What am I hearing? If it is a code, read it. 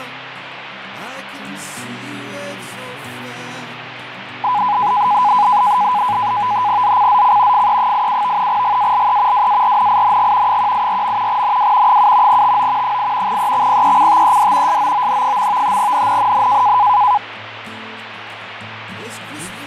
NAVTEX (SITOR-B), 100 baud, 170 Hz shift, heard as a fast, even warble, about 910 Hz centre, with radio static. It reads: ZCZC FE87 GALE WARNING 184. NW 7 TO 8 EXPECTED SOON. NNNN